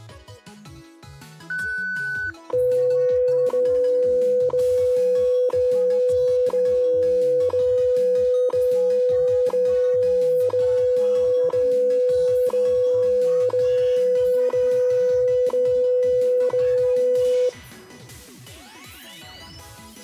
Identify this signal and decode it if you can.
Radio time signal (WWV, Colorado), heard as ticks, one a second.